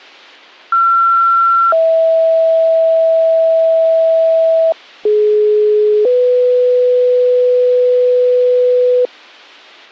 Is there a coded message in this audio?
Yes: two-tone page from 0.7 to 9.1 s, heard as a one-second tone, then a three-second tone, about 1360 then 650 Hz, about 420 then 500 Hz.